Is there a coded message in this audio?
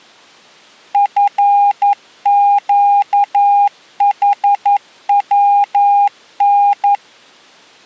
Yes: Morse code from 0.9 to 7.0 s, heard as a keyed tone, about 11 wpm, 810 Hz. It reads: FQHWN